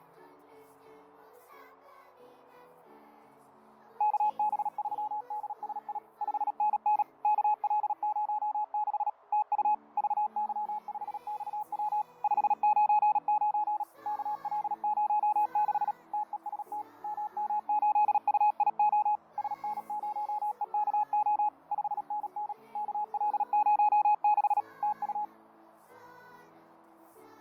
Morse code, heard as a keyed tone, machine-sent, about 37 wpm, 840 Hz, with fading. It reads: KB3DSI 5NN KL06 TU VY5XW 599 KL06 TEST MM8UIO SN0EKO 5NN KL06 TU